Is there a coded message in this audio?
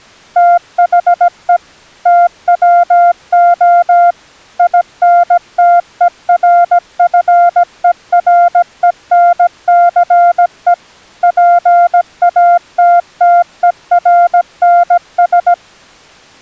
Yes: Morse code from 0.3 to 15.6 s, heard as a keyed tone, machine-sent, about 17 wpm, 700 Hz. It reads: THE TWO INTERFERENCE PATTERNS